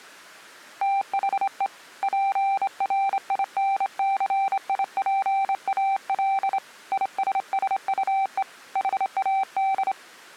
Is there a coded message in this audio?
Yes: Morse code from 0.8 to 10.0 s, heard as a keyed tone, hand-sent with a straight key, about 26 wpm, 780 Hz. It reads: THE PRINCIPAL ISSUE HAD